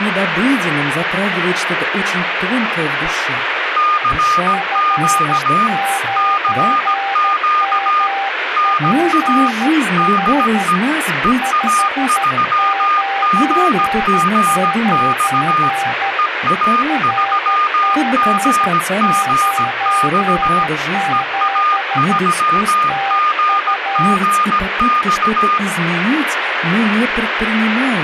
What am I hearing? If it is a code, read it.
Morse code, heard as two keyed tones, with radio static. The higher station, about 17 wpm, 1220 Hz: CQ CQ NA DE EA3GGX EA3GGX EA3GGX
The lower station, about 13 wpm, 790 Hz: F9MPH 599 RG97 TU